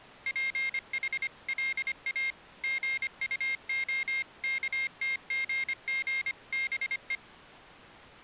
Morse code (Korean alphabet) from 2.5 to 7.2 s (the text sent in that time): 싶었다